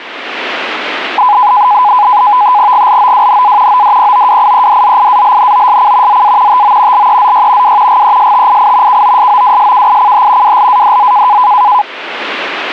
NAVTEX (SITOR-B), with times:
2.7-3.8 GLOWNA
3.7-6.2 ODPOWIEDZIALNOSC
6.1-6.6 ZA
6.5-7.1 TO
6.9-7.8 LEZY
7.6-8.0 W
7.9-9.0 GESTII
8.9-10.6 KOSOWSKICH
10.4-11.4 WLADZ

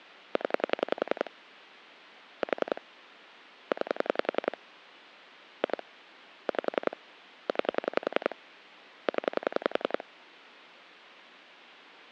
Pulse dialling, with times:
0.4-1.3 0
2.4-2.8 4
3.7-4.6 9
5.6-5.8 2
6.5-7.0 5
7.5-8.4 9
9.1-10.0 0

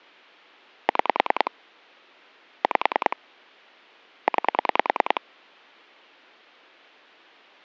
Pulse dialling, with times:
0.9-1.5 6
2.6-3.2 5
4.3-5.2 9

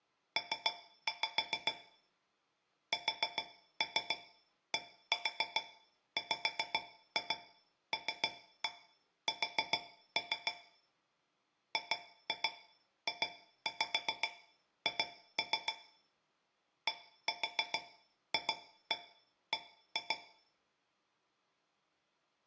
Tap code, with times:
0.4-1.7 P
2.9-10.5 SDWLS
11.7-15.7 GJH
16.9-20.2 DFB

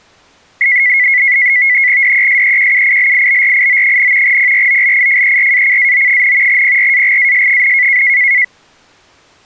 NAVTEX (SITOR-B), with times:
2.0-4.4 DESEQUILIBRIO,
4.2-6.6 PROLIFERACAO,
6.5-8.0 PRAGAS,

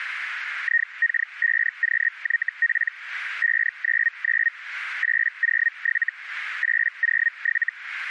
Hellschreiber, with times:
0.6-2.9 IK5QYP
3.4-4.5 599
5.0-6.1 807
6.6-7.7 807

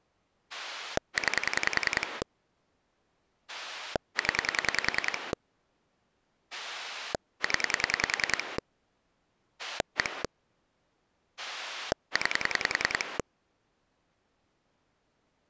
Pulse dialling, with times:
0.5-2.2 9
3.5-5.3 0
6.5-8.6 0
9.6-10.2 1
11.4-13.2 9

